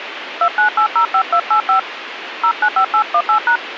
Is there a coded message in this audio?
Yes: DTMF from 0.4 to 3.6 s, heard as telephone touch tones, dialled by hand, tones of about 90 ms, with radio hiss. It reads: 29805285 095818#